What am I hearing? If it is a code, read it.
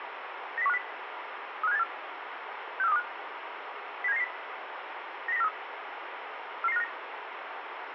Five-tone selective call (EEA), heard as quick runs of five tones, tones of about 40 ms, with radio hiss and room echo. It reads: 90150 35784 64325 07990 90943 44959